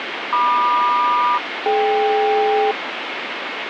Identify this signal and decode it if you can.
Aircraft SELCAL, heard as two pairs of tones, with radio static. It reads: MQ-DK